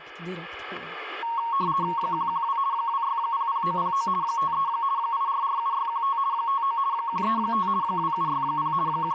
RTTY (50 baud, 170 Hz shift), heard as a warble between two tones, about 1010 Hz centre, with static crashes. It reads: 112 2600909 53 8447615 59 135 2760 …